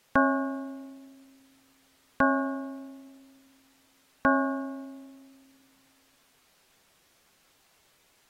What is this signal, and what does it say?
Clock strike, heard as a bell. 3. Three o'clock.